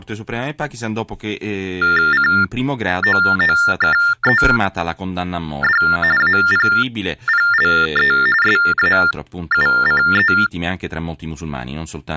TTY/TDD text telephone tones (45.45 baud Baudot), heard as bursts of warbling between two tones, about 400 Hz shift, 1600 Hz centre, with speech in Italian. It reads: COOKED APPLE SAUCE